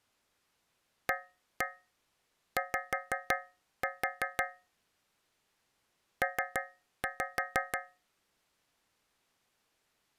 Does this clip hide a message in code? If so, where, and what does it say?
Yes: tap code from 1.1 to 8.1 s, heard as taps on a metal pipe, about 6 knocks a second. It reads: AY P